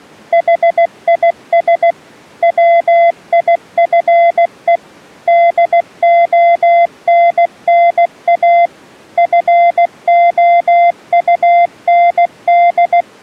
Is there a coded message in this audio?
Yes: Morse code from 0.3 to 13.1 s, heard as a keyed tone, machine-sent, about 16 wpm, 690 Hz. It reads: HIS WIFE DONNA FOUND